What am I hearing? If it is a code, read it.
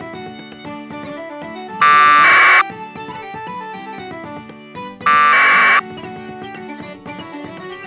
Packet radio (AX.25, as in APRS), 1200 baud, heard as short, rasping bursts.